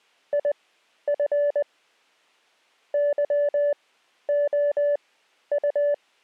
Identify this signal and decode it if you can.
Morse code, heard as a keyed tone, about 20 wpm, spaced as for 11 wpm, 580 Hz. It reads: IF YOU